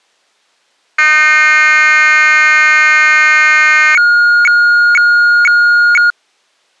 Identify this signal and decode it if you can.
Weather fax (radiofax), 120 lines a minute, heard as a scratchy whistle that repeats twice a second.